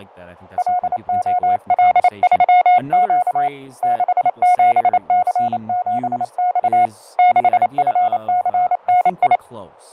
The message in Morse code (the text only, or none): LOL3Q 67C7X 6FCNI